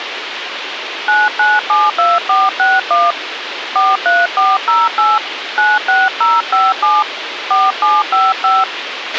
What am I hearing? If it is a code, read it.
DTMF, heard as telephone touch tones, dialled by hand, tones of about 200 ms, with radio hiss and a squelch burst at the end. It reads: 9972461 43408 96057 4755